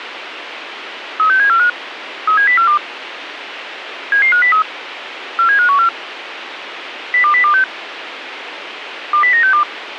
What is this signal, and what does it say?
Five-tone selective call (CCIR), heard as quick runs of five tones, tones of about 100 ms, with radio hiss. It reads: 36745 37042 77503 47514 02026 20962